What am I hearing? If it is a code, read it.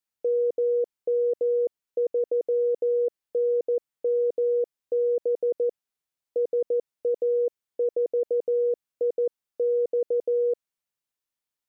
Morse code, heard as a keyed tone, hand-sent with a paddle, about 14 wpm, 480 Hz. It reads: MM3NMB SA4IX